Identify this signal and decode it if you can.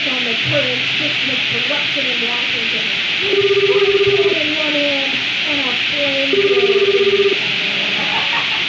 Telephone call progress tone (Japanese plan), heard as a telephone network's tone, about 380, 400, 420 Hz, 1 s on and 2 s off, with hum and room echo. Ringback tone.